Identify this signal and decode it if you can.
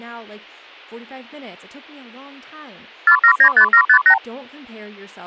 Multi-frequency trunk signalling (R2, with the far end's replies), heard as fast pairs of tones, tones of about 80 ms, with speech in English. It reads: 4795758